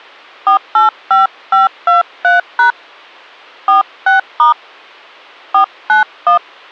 DTMF, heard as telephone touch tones, dialled by hand, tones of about 130 ms. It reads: 485523# 46* 491